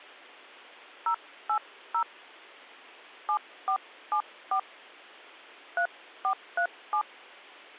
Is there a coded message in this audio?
Yes: DTMF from 1.1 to 7.0 s, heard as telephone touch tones, dialled by hand, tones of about 80 ms. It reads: 080 7474 3437